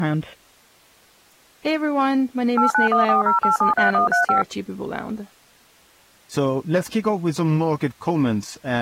DTMF, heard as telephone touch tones, dialled by machine, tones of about 130 ms, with speech in English. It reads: 89140873135